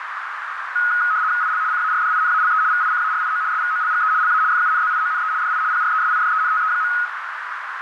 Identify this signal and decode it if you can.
RTTY (75 baud, 170 Hz shift), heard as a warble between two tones, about 1360 Hz centre, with radio static and a narrow filter. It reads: IL CARDINALE VICARIO SVOLGE LA FUNZIONE DI PRESIDENTE.